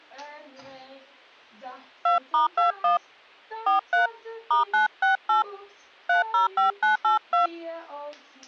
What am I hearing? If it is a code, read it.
DTMF, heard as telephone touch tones, dialled by hand, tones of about 130 ms. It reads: 2*21 43 *968 305982